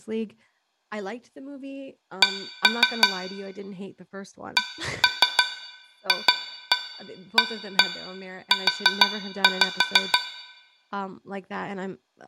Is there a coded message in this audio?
Yes: tap code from 2.2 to 10.3 s, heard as taps on a metal pipe, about 6 knocks a second, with room echo and speech in English. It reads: C CFAU